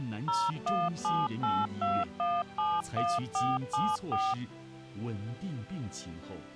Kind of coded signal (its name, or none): DTMF